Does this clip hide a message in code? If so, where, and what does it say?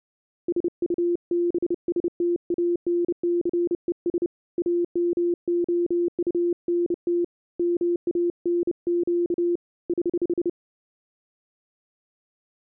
Yes: Morse code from 0.4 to 10.6 s, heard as a keyed tone, hand-sent with a bug key, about 30 wpm, 350 Hz. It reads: SUBSTANCES AMOUNT MANQ <HH>